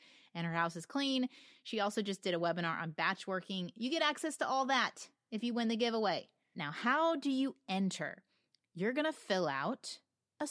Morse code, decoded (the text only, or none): none